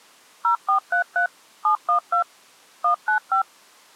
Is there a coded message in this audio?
Yes: DTMF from 0.4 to 3.4 s, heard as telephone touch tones, dialled by machine, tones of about 100 ms. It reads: 0433 712 195